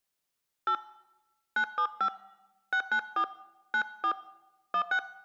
DTMF, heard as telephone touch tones, dialled by hand, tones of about 80 ms. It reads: 8 975 694 94 16